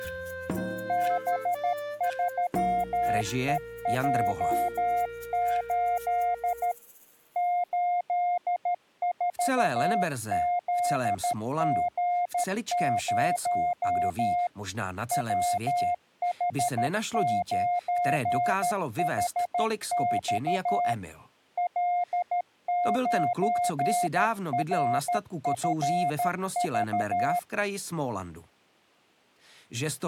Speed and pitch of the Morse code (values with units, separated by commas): 13 wpm, 710 Hz